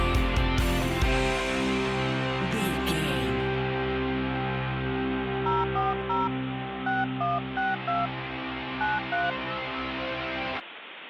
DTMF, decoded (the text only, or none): 040 6162 93